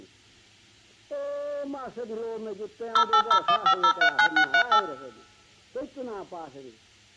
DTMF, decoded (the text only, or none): 08015039638